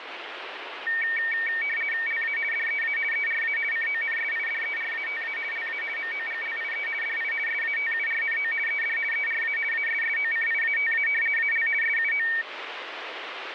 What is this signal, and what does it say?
RTTY (50 baud, 450 Hz shift), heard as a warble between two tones, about 2050 Hz centre, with radio static. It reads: LA DEA ERA CONSIDERATA LA MOGLIE DI SATURNO ED ERA ASSOCIATA AL SUO